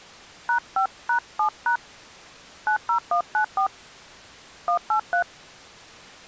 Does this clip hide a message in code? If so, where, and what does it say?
Yes: DTMF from 0.5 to 5.2 s, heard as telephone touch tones, dialled by hand, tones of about 100 ms. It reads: #5#7# 90194 183